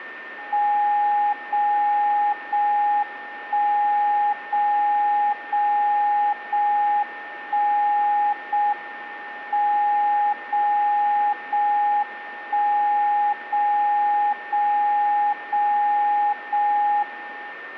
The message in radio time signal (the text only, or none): 0 0 1 0 0 0 1 0 M 0 0 1 0 0 0 0 1